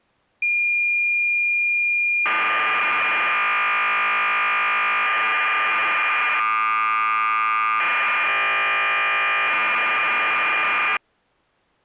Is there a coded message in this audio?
Yes: cassette data (Kansas City type), 1200 baud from 0.4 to 11.0 s, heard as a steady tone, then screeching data.